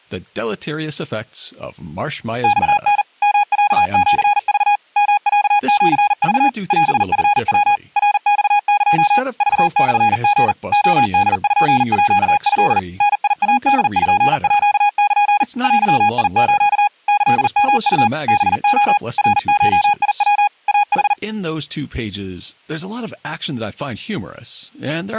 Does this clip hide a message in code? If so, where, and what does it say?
Yes: Morse code (Japanese Wabun code) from 2.4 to 21.2 s, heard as a keyed tone, machine-sent, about 40 wpm, 820 Hz, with speech in English. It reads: マタ ヨロシク ヨロシク オチヤ ナマエ クモリ レポート ダイポール デス キヨウ ハレ ナゴヤ イヌ